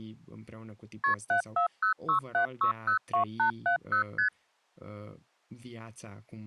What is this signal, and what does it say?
Multi-frequency trunk signalling (R1, as on North American trunks), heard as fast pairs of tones, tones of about 100 ms, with speech in Romanian. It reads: KP 74067602870 ST